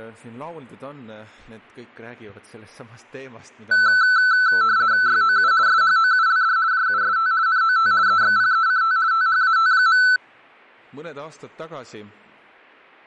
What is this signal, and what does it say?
RTTY (50 baud, 170 Hz shift), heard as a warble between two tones, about 1420 Hz centre. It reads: YOU SHOULD JUST NOT EXPECT THAT.